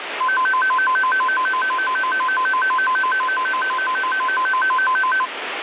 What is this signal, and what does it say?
A tone that alternates evenly between two pitches, with radio static. There is no code.